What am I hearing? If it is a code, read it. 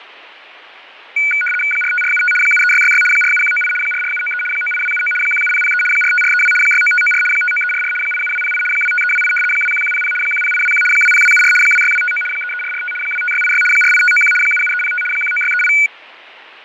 RTTY (75 baud, 850 Hz shift), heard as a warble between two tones, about 1900 Hz centre, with radio static and fading. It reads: 45475 73666 47198 44793 98279 17003 45432 69594 59344 87208 25328 21100 10821 20274 26259 33445 25686 48591 77305 19638